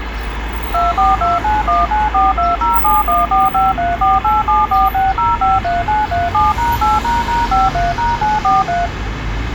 DTMF, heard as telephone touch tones, dialled by machine, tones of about 180 ms, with phone line noise and street noise. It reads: 2429194207145348746053937#8##53#943